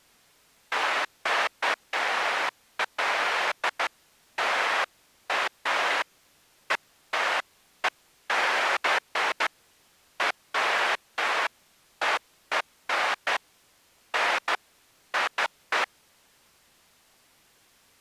Bursts of noise. There is no code.